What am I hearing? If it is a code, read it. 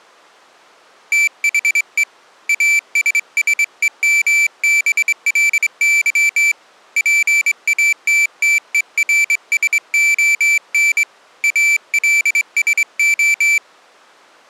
Morse code, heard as a high beeper, hand-sent with a straight key, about 24 wpm, 2350 Hz. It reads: THE ASSEMBLY PATTERSON ALSO